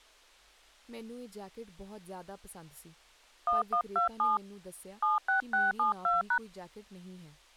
DTMF, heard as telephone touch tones, dialled by hand, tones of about 130 ms, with speech in Punjabi. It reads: 1127 76672#